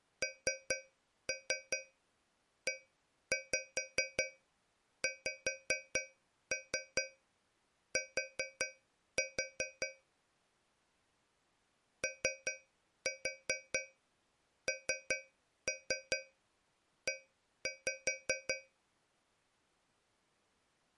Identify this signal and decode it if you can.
Tap code, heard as taps on a metal pipe, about 5 knocks a second. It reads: NEXT ONE